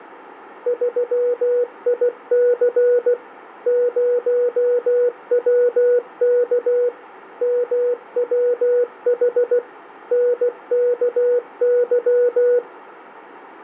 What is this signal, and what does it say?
Morse code, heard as a keyed tone, machine-sent, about 16 wpm, 490 Hz. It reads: 3IC 0WK MWH NKY